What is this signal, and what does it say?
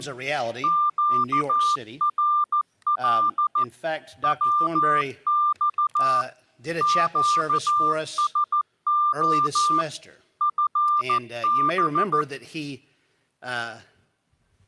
Morse code, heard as a keyed tone, machine-sent, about 14 wpm, 1190 Hz. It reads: QRL WX QSO FB